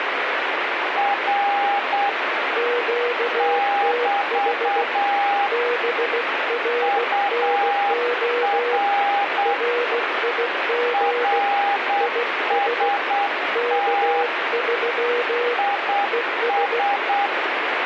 Morse code, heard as two keyed tones, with radio static. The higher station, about 8 wpm, 810 Hz: R <BT> UR RST IS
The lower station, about 16 wpm, 480 Hz: QTH BRNO RIG IS K3 ES